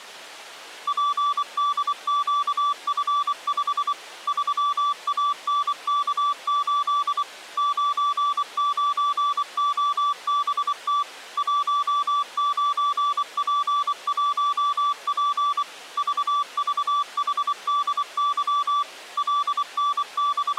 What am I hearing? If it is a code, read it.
Morse code, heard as a keyed tone, machine-sent, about 24 wpm, 1160 Hz. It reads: PDQF5 3ANK8 99OBT 19P1P VVHDY …